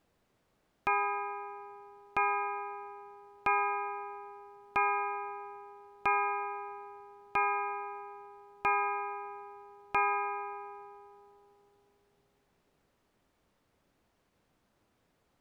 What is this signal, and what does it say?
Clock strike, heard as a bell. 8. Eight o'clock.